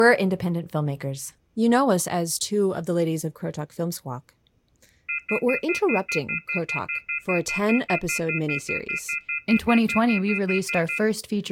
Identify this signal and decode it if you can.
Telephone call progress tone (North American plan), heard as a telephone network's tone, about 1400, 2050, 2450, 2600 Hz, 0.1 s on and 0.1 s off, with speech in English. Off-hook warning tone.